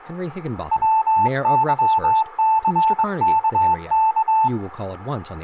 Morse code, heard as a keyed tone, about 22 wpm, 880 Hz, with room echo and speech in English. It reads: WYCKK